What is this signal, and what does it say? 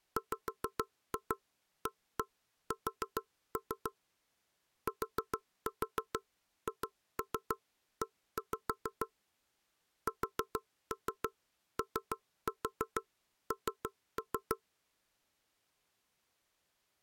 Tap code, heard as knocks on wood, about 6 knocks a second. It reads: WAS THE SON